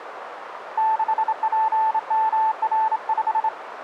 Morse code, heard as a keyed tone, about 27 wpm, 880 Hz, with radio static and a narrow filter. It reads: 6PMR5